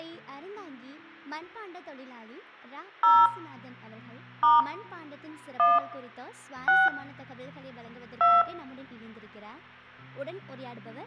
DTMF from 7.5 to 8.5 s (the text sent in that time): 2